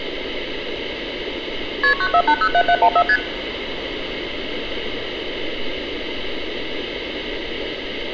Multi-frequency trunk signalling (R1, as on North American trunks), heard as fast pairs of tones, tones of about 70 ms, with street noise. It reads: KP 94807714 ST